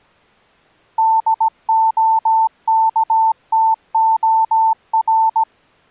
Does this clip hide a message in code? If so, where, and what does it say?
Yes: Morse code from 0.9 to 5.5 s, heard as a keyed tone, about 17 wpm, 890 Hz. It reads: DOKTOR